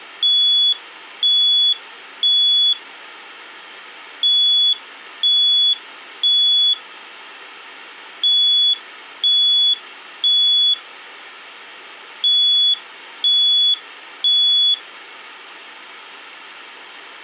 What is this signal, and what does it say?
Alarm pattern, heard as an alarm's beeps, played four times, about 3400 Hz. Temporal three. Smoke or fire, evacuate.